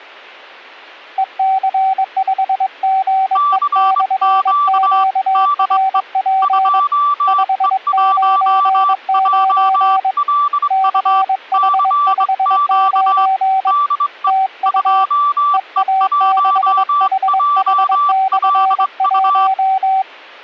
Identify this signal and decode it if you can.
Morse code, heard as two keyed tones. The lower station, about 22 wpm, 770 Hz: EC5GE/QRP 599 CH59 TU EA6HH/1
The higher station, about 23 wpm, 1160 Hz: CQ DE 2E1JLU CQ DE 2E1JLU